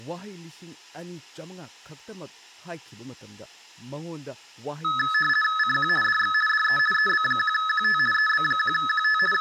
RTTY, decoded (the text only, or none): CQ DX DE EB1QT EB1QT …